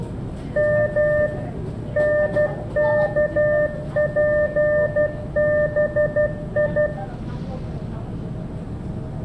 Morse code (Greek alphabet), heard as a keyed tone, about 12 wpm, 600 Hz, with room echo and the noise inside a subway train. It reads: Μ ΝΚΠΒΙ